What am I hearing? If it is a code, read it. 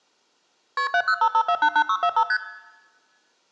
Multi-frequency trunk signalling (R1, as on North American trunks), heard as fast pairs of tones, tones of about 70 ms, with room echo. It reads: KP 7055488645 ST